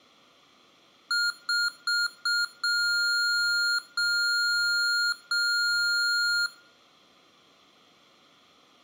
Beep code, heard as beeps from a small speaker, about 1410 Hz, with room echo. 4 short, 3 long.